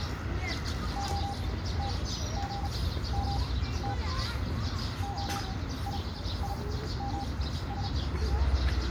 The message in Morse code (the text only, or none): OTGMT OIIMS